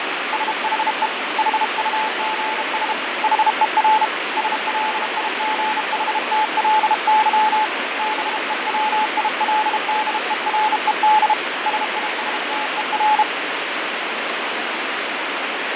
Morse code, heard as a keyed tone, hand-sent with a bug key, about 32 wpm, 860 Hz, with heavy radio static and fading. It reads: SHE HUGS HER SLIGHTLY BEWILDERED SISTER